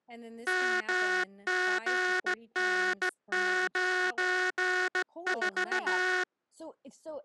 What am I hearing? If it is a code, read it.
Morse code, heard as a buzzer, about 16 wpm, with speech in English. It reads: MGN94